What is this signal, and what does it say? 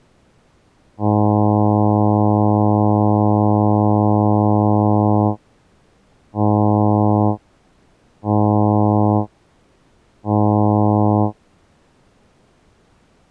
Ship horn signal, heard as a ship's horn, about 100 Hz. 1 long, 3 short. At sea: a vessel under tow in fog.